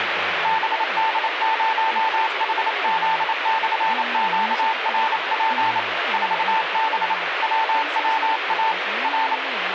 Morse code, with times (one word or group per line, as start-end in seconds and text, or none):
0.5-5.8 BD0HZ/QRP
6.1-7.1 4B
7.4-8.7 WWA
9.0-9.4 R